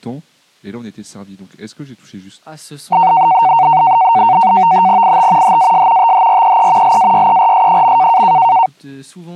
NAVTEX (SITOR-B), 100 baud, 170 Hz shift, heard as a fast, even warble, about 840 Hz centre, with speech in French. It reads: IT HAS THREE LAYERS.